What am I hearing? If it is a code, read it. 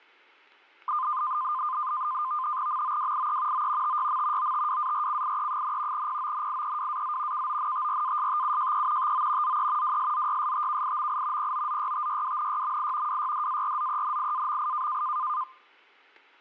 NAVTEX (SITOR-B), 100 baud, 170 Hz shift, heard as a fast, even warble, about 1120 Hz centre. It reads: MOWIE O TYM OTWARCIE, PONIEWAZ KONTRASTUJE TO ZE WSZYSTKIMI POZYTYWNYMI WYDARZENIAMI